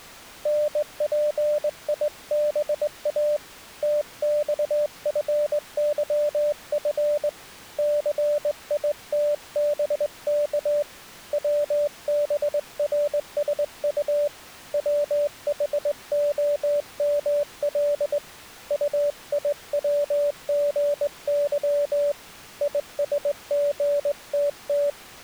Morse code, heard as a keyed tone, hand-sent with a straight key, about 20 wpm, 590 Hz. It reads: NPIBA TXFYF CITBK WBRSU WHOML UIWGY ISGTT